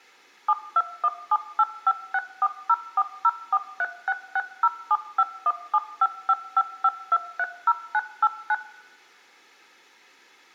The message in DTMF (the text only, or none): 721785640404366075175555230989